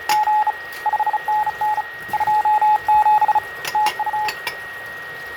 Morse code, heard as a keyed tone, hand-sent with a bug key, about 35 wpm, 850 Hz, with radio static, fading, a steady whistle near 1880 Hz and kitchen noise. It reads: … 5NN 27 TU